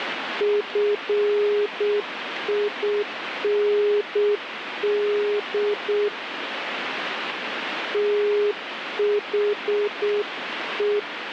Morse code, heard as a keyed tone, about 7 wpm, 410 Hz, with radio static. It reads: FIND THE